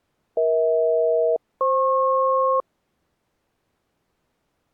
Aircraft SELCAL, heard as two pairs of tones. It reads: EH-FP